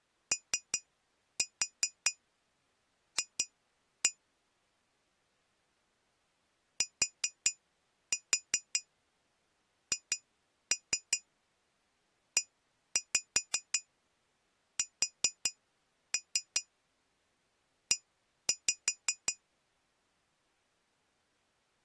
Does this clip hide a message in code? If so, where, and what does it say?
Yes: tap code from 0.3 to 19.4 s, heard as taps on glass, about 5 knocks a second. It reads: OF THESE